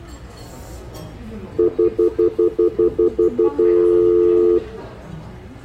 Telephone call progress tone (North American plan), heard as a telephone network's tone, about 350, 440 Hz, 0.1 s on and 0.1 s off, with the noise of a restaurant. Stutter dial tone.